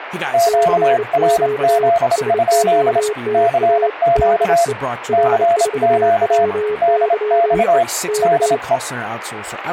Morse code, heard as two keyed tones, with radio static and speech in English. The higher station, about 27 wpm, 680 Hz: QRZ? CQ CQ DX DE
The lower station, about 29 wpm, 420 Hz: CQ SOTA DE R4WYE K